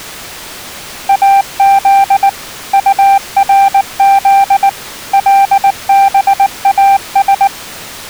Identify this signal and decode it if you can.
Morse code (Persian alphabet), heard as a keyed tone, machine-sent, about 19 wpm, 790 Hz. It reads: از طرز لباس